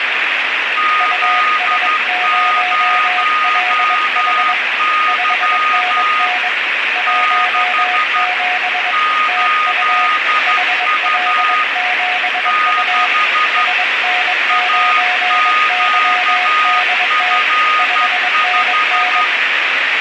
Morse code, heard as two keyed tones, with heavy radio static. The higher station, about 12 wpm, 1240 Hz: Z0Y 6 8U 6 AQF5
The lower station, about 22 wpm, 730 Hz: US0LH 5NN 17 TU HL7U SN9YDT 5NN